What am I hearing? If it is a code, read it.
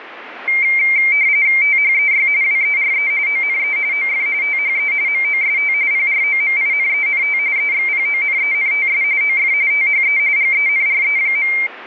RTTY (45.45 baud, 170 Hz shift), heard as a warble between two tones, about 2200 Hz centre, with radio static. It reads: THEY WERE ONE OF THE MOST PROMINENT EXPONENTS OF THE GENRE.